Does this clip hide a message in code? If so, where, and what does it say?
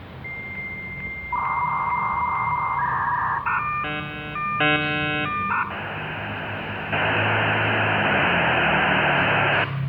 Yes: dial-up modem handshake (V.34 or later) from 0.2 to 9.6 s, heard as a whistle, warbles, then hiss, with room echo and the noise of a residential street.